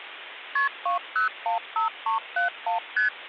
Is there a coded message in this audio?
Yes: multi-frequency trunk signalling (R1, as on North American trunks) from 0.6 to 3.1 s, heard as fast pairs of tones, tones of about 120 ms, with phone line noise. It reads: KP 2015371 ST